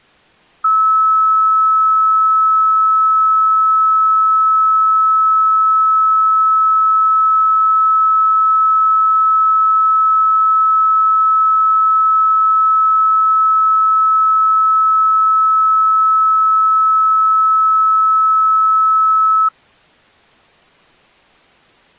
A steady tone. There is no code.